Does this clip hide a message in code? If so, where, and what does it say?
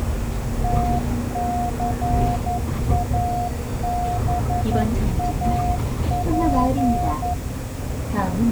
Yes: Morse code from 0.6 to 7.4 s, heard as a keyed tone, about 11 wpm, 710 Hz, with the noise inside a bus. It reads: TCABAP